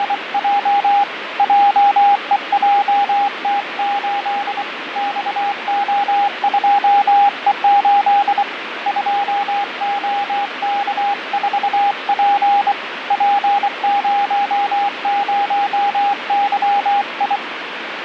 Morse code, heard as a keyed tone, hand-sent with a bug key, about 24 wpm, 810 Hz, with radio static and fading. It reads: … JEJT8 XO2E8 2OK4P P00YI